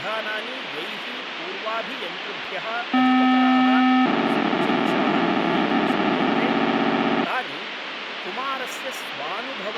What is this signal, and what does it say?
POCSAG pager data (512 baud), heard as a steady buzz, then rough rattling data, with radio hiss, a squelch burst at the end and speech in Sanskrit.